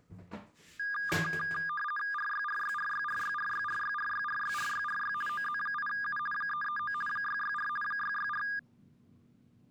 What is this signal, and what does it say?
RTTY (50 baud, 450 Hz shift), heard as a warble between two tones, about 1420 Hz centre, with the noise of a restroom. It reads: RYRYRYRYRYRYRYRYRYRY OZ8U 339 664 664